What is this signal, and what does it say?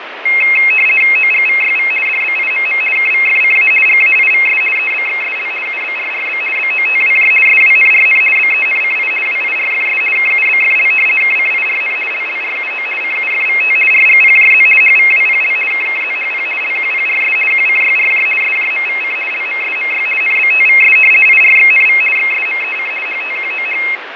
RTTY (50 baud, 450 Hz shift), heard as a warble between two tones, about 2350 Hz centre, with radio static and fading. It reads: OGVYV DBIMM KVFCA GAIVS EBXSL UBRRB BOTWJ SWNRN BENCI WIRFS KUBFL KCIRN LLRUO CUFVT RGPJZ HVWPL KKZHP LQPRS QCYRJ SJMVC LMSMY NBTVS IRXNV XSMEC HTQOH